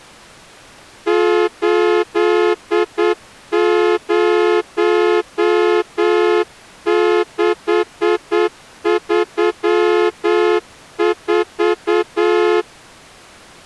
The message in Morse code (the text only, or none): 80634